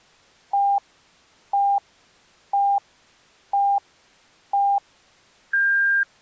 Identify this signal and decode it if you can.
Radio time signal (five pips and a higher one, as on Chinese radio), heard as pips.